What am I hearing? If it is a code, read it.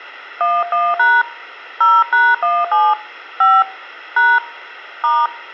DTMF, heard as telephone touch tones, dialled by hand, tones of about 220 ms. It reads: 11# 0#17 5 # *